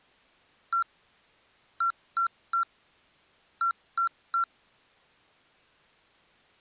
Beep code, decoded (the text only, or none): 1-3-3